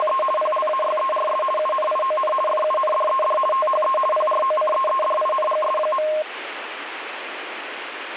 RTTY (50 baud, 450 Hz shift), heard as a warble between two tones, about 840 Hz centre, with radio static. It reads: … PLAYERS UNION FUNDED THE PROCEEDINGS.